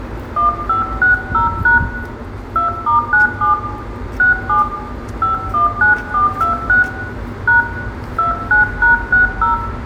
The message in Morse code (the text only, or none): none